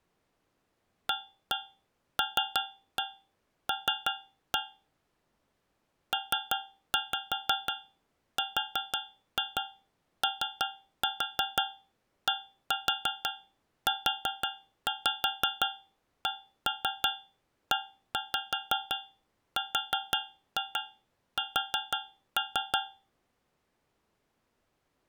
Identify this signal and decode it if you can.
Tap code, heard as taps on a metal pipe, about 5 knocks a second. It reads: ALL PRODUCERS